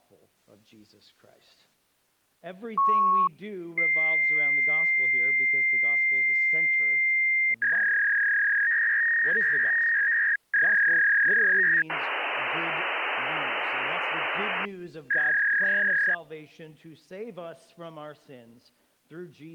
Fax machine handshake, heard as a beep, a long tone, a warble and hiss.